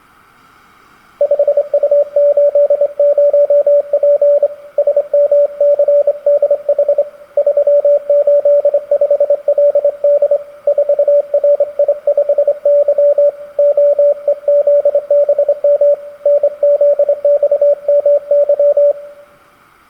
Morse code, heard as a keyed tone, hand-sent with a straight key, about 25 wpm, 580 Hz, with room echo. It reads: 5U80P SMCDH 385LD 4RI5Y OEZBM NZXMY